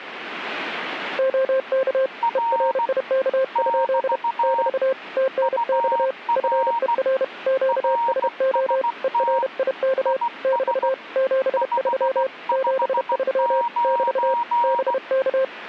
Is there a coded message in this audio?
Yes: Morse code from 1.1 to 15.5 s, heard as two keyed tones. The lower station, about 31 wpm, 530 Hz: OK ERIK? <BT> TNX FER QSO ERIK <BT> 73 73 <BT> BK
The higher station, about 16 wpm, 940 Hz: R <BT> UR RST IS 559